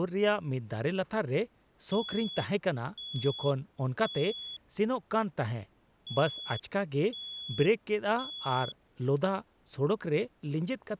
Alarm pattern, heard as an alarm's beeps, played twice, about 3400 Hz, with speech in Santali. Temporal three. Smoke or fire, evacuate.